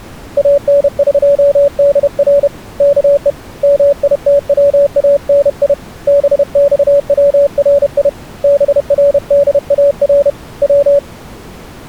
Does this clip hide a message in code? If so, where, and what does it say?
Yes: Morse code (Persian alphabet) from 0.3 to 11.0 s, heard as a keyed tone, hand-sent with a paddle, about 31 wpm, 570 Hz. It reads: انقدر که میتوانی بخوری بردار و